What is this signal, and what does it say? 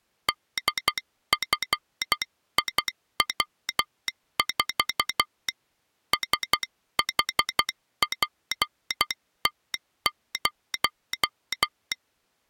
Morse code, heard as a telegraph sounder, hand-sent with a paddle, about 12 wpm. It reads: DFIW4 SHPT0